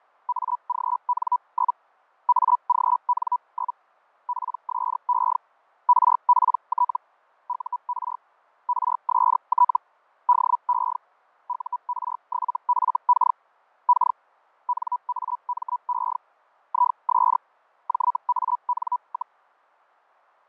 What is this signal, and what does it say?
Hellschreiber (Feld-Hell, 122.5 baud), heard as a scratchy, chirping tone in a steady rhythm, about 980 Hz, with fading. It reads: AGN? AGN? PSE RPT UR RST DE UR7FK K NAME IS JAN,